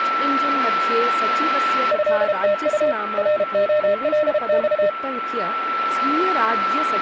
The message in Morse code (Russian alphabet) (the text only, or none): ЭТУ РОЛЬ